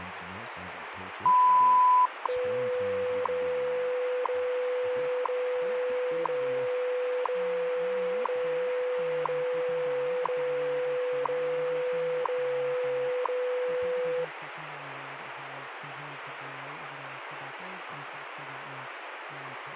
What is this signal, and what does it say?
Radio time signal (WWV, Colorado), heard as ticks, one a second, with radio static and speech in English.